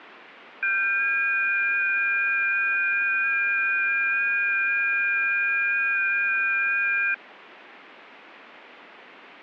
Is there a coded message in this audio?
Yes: FT8 (several signals at once) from 0.6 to 7.1 s, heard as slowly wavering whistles, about 6.25 baud.